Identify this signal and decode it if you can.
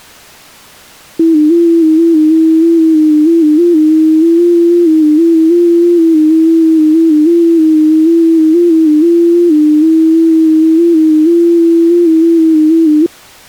FT8 (one signal), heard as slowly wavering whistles, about 6.25 baud.